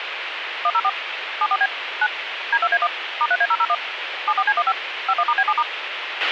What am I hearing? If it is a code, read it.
DTMF, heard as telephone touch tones, dialled by machine, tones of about 50 ms, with radio hiss and a squelch burst at the end. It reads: 104 74B 9 D2A1 *3A001 74C15 51*B7*